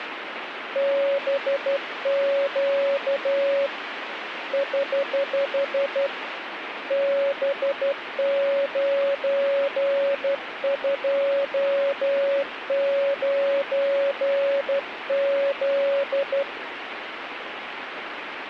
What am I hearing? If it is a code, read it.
Morse code, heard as a keyed tone, hand-sent with a straight key, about 12 wpm, 560 Hz, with radio static. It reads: BQ <HH> B929Z